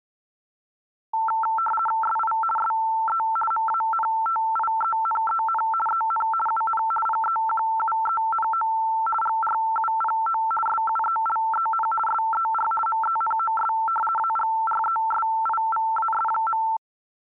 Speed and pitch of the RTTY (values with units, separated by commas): 50 baud, 450 Hz shift, 1120 Hz centre